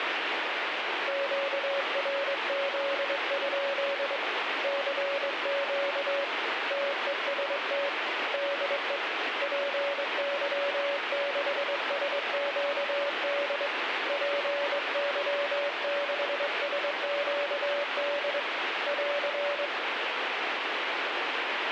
Morse code, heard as a keyed tone, hand-sent with a straight key, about 22 wpm, 570 Hz, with radio static. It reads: QRZ? CQ TEST DE PY6SQD PY6SQD <AR>